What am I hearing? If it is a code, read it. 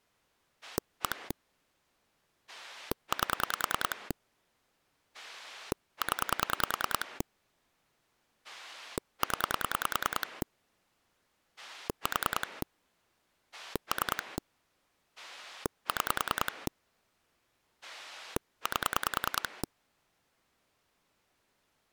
Pulse dialling, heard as a rotary dial, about 10 pulses a second. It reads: 1 8 0 0 4 3 6 8